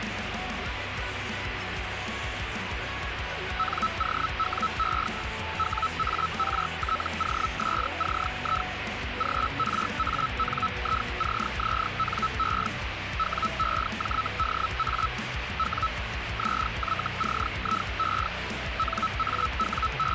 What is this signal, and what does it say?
Hellschreiber (Feld-Hell, 122.5 baud), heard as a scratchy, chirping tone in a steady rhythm, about 1310 Hz, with radio static. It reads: NOWE WARTOSCI GRANICZNE WEJDA W ZYCIE …